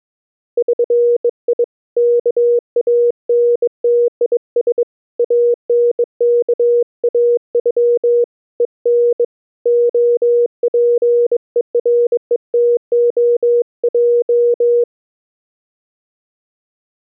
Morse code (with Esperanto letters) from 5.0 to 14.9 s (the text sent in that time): ANKAŬ EN OPERETOJ